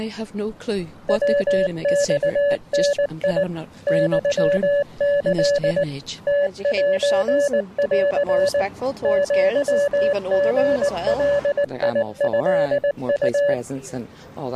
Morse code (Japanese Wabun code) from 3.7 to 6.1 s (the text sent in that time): ユキ